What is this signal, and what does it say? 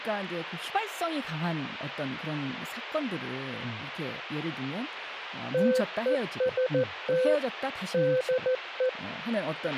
Morse code, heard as a keyed tone, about 14 wpm, 510 Hz, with a squelch burst at the end and speech in Korean. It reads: TEST DE